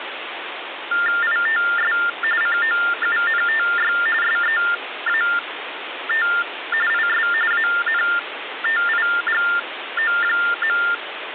TTY/TDD text telephone tones (45.45 baud Baudot), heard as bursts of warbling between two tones, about 400 Hz shift, 1600 Hz centre, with phone line noise. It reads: ITS COUNTY SEAT IS ANTIGO.